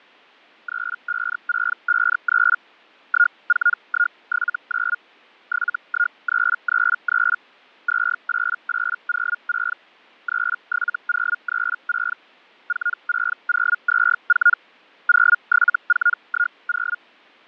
Hellschreiber (Feld-Hell, 122.5 baud), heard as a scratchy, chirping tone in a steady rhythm, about 1430 Hz, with fading. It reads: 35653 14179 71333 28806 37036 46024 07410